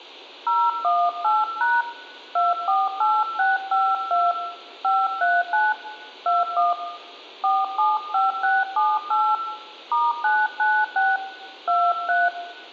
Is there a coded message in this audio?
Yes: DTMF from 0.5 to 12.3 s, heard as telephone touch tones, dialled by hand, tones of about 210 ms, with room echo. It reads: 018# 248652 539 21 475678 *996 23